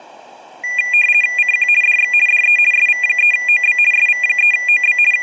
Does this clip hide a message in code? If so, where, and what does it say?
Yes: RTTY (50 baud, 450 Hz shift) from 0.6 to 5.2 s, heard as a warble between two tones, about 2200 Hz centre, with room echo. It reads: CQ DX DE SV3OB SV3OB …